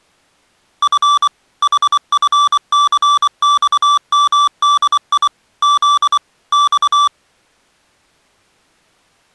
Morse code, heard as electronic beeps, machine-sent, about 24 wpm, 1160 Hz. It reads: F HFCXMDI Z X